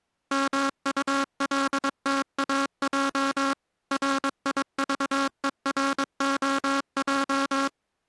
Morse code, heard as a buzzer, machine-sent, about 22 wpm. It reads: MULTAJ RIVEROJ